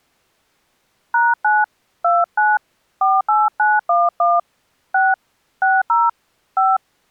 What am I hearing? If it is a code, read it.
DTMF, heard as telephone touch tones, dialled by hand, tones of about 200 ms. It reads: #9 29 48911 6 60 5